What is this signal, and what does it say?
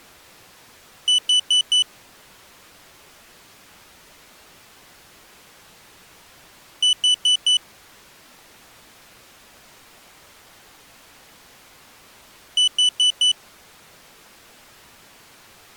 Alarm pattern, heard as an alarm's beeps, played three times, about 3000 Hz. Temporal four. Carbon monoxide.